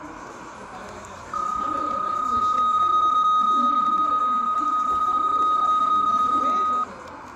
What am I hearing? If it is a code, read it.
PSK31 (31.25 baud), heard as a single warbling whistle, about 1250 Hz, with radio static and the noise of a crowd indoors.